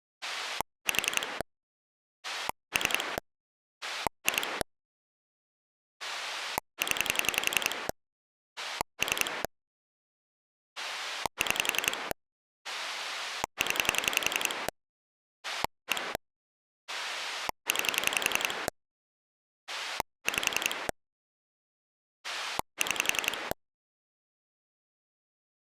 Pulse dialling, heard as a rotary dial, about 11 pulses a second. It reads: 4 3 2 0 3 6 0 1 9 5 6